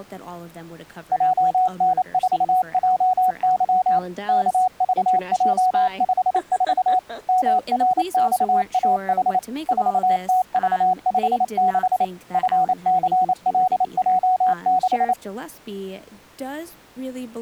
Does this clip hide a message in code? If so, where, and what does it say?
Yes: Morse code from 1.1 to 15.2 s, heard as a keyed tone, machine-sent, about 28 wpm, 740 Hz, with speech in English. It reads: JN4JY KVJ54 MRXAH 4TV56 FCLJ6